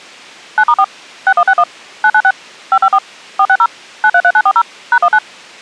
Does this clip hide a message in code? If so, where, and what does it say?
Yes: DTMF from 0.6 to 5.2 s, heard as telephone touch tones, dialled by machine, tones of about 60 ms. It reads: 9*4 6161 996 554 460 933940 #19